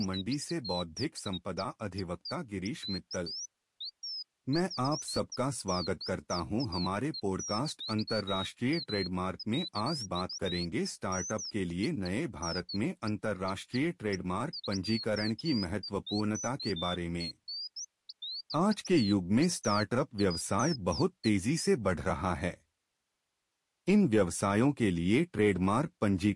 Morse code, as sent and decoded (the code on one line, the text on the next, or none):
none